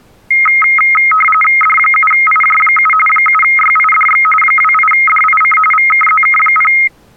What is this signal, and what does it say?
RTTY (45.45 baud, 850 Hz shift), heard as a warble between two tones, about 1700 Hz centre. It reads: D7IJ7 7YIDX 28DIC VKZK0